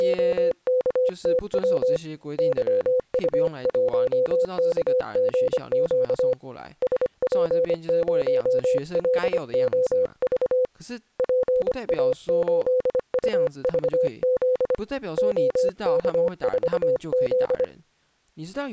Morse code, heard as a keyed tone, hand-sent with a paddle, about 25 wpm, 510 Hz, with speech in Chinese. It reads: … YU1KGQ SP0LOV PA8UVZ OK4Z